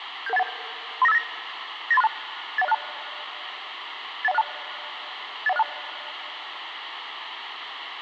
Five-tone selective call (EIA), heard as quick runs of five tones, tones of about 30 ms, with radio hiss. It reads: 77181 39589 98362 81062 81062 81062